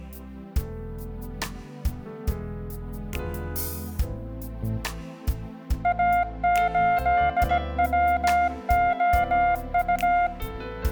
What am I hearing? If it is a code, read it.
Morse code, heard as a keyed tone, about 17 wpm, 700 Hz, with room echo. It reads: A8WOU